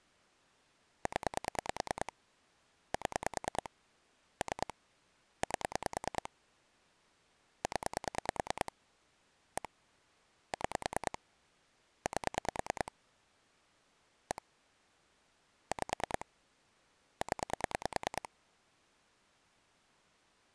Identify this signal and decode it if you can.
Pulse dialling, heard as clicks on a phone line, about 9 pulses a second. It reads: 0 7 3 8 0 1 6 8 1 5 0